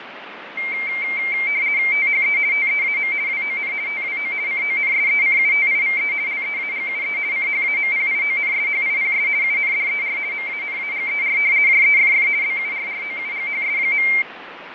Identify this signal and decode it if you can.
RTTY (50 baud, 170 Hz shift), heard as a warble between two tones, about 2200 Hz centre, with radio static and fading. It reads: THE TEAM WON TWO CONSECUTIVE LEAGUE CHAMPIONSHIPS UNDER MANAGER JEFF BURROUGHS.